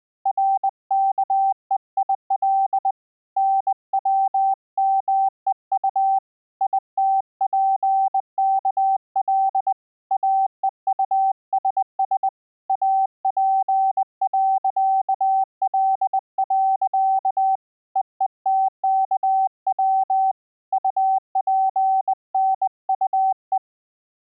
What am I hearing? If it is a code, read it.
Morse code, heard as a keyed tone, hand-sent with a bug key, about 20 wpm, 770 Hz. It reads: RKEIL NWMEU ITPKL AEUSS AP.L. EETKW UPNUE